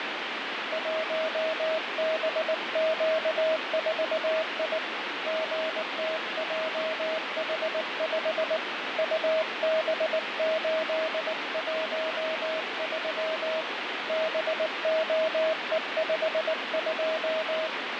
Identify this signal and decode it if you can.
Morse code, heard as a keyed tone, hand-sent with a paddle, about 19 wpm, 640 Hz, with radio static. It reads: 1BQ4I GTJH5 UB813 BOE52